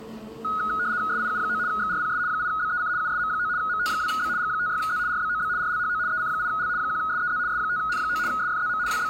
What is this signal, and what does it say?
RTTY (75 baud, 170 Hz shift), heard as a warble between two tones, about 1360 Hz centre, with the noise of a cafe. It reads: SIU9 XRPS 8BEC USM9 MT2B G56Z RBOB RLHO EC8L 1SEZ S5N9 SFZM …